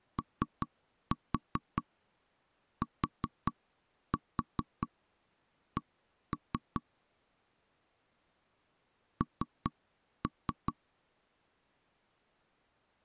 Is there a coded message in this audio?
Yes: tap code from 0.2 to 10.8 s, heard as knocks on wood, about 4 knocks a second. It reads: OTC N